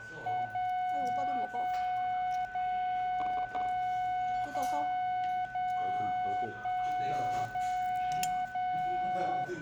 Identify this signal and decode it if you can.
Radio time signal (DCF77), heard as a tone whose level steps once a second, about 730 Hz, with a steady whistle near 1500 Hz and the noise of a restaurant. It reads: 0 0 0 0 0 0 1 0 0